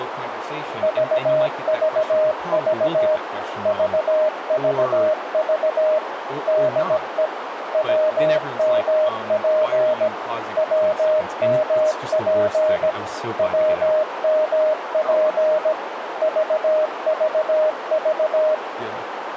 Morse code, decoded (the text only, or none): VVV VVV DE WMP WMP WMP VVV